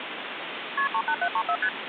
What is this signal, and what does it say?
Multi-frequency trunk signalling (R1, as on North American trunks), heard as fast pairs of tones, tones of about 70 ms, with phone line noise. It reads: KP 38734 ST